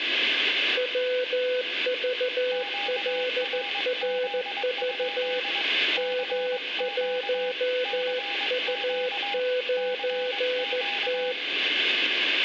Morse code, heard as two keyed tones, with radio static and room echo. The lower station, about 14 wpm, 500 Hz: WVLRV M1U9T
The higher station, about 22 wpm, 810 Hz: QRZ? CQ CQ CQ